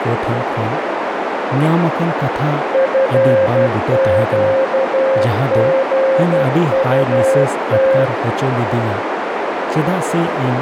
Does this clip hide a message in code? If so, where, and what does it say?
Yes: Morse code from 2.7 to 8.1 s, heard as a keyed tone, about 12 wpm, 530 Hz, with heavy radio static, a narrow filter and speech in Santali. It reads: FQGUT